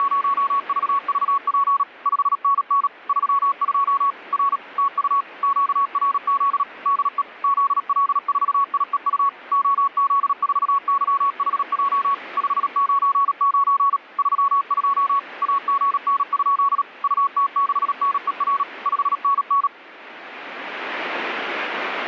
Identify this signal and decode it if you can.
Morse code, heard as a keyed tone, machine-sent, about 37 wpm, 1120 Hz, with radio static. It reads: … 5NN 32 R TU QRZ DE ZL4IEU OZ4YHJ 599 32 AGN? UT6NER 5NN